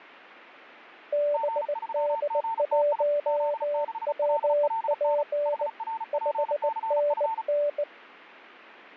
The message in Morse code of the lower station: BD1WP 5NN

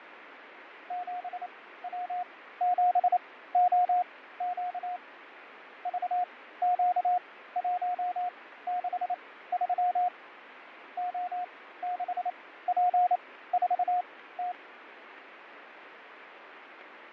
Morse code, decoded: 7W7OQ VQ163 O6P4T

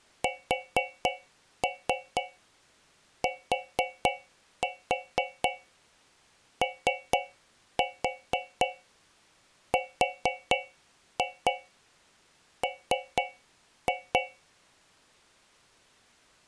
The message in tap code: STORM

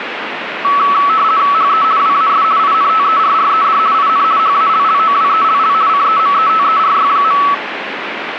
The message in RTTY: HE WAS INTERRED IN HALLOWELL CEMETERY.

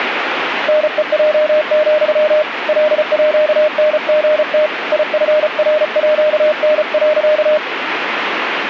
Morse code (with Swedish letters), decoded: NEJ, LÅNGT IFRÅN.

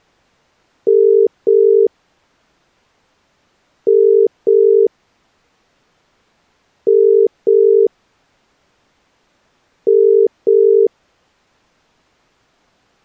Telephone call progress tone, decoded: ringback tone

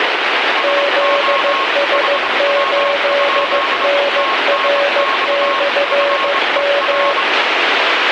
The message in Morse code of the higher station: SO HW? TNX FER

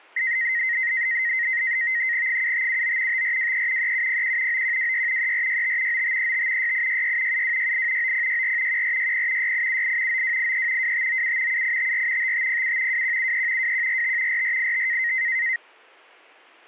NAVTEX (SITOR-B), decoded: 7579 5423 3701 9126 3465 9535 6866 7268 9064 1460 6878 9283 2597 7854 5507 2173 2145 4485

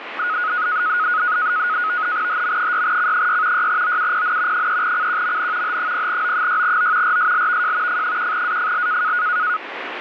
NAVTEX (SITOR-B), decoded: HM6C6 6OUPN 3CQMN H0O6O RSLVJ F1AFL

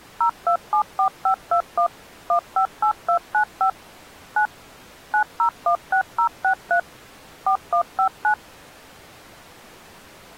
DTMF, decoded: 0274521 158295 9 9016063 4159

